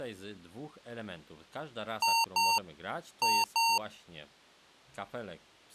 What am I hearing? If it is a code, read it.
Beep code, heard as beeps from a small speaker, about 920 Hz, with speech in Polish. 2-2.